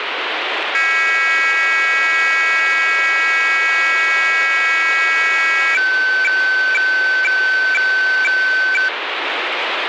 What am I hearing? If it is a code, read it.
Weather fax (radiofax), 120 lines a minute, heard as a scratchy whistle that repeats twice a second, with radio static.